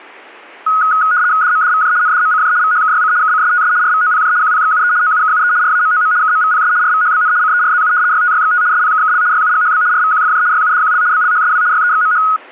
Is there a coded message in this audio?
Yes: RTTY (75 baud, 170 Hz shift) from 0.7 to 12.4 s, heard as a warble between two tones, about 1360 Hz centre. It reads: DMDVJ NDMCJ VHKYC KCSTS RVOPJ QPXUE OUKUE RAMOM KMVPS RVHBN CERZU YTYXT SPKKL YUGHB RVQFJ YUDQL BLHSW YEXMH